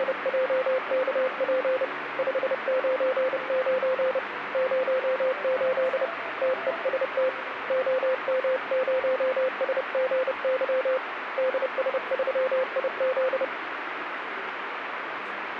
Morse code, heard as a keyed tone, hand-sent with a paddle, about 30 wpm, 520 Hz, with radio static. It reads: … 599 08 TEST OM0SGY DS3IZ